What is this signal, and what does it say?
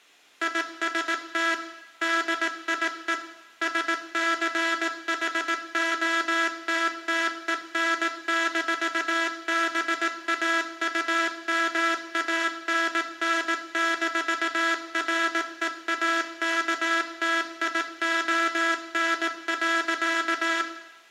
Morse code, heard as a buzzer, machine-sent, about 18 wpm, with room echo. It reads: IST DIE SCHOTTEN-BAUMANN-REAKTION.